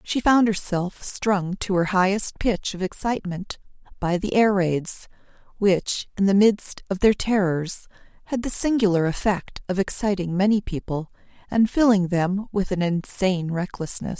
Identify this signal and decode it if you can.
Speech in English. There is no code.